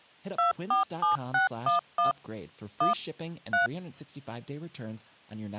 DTMF, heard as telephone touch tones, dialled by machine, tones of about 130 ms, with speech in English. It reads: 247611 1 3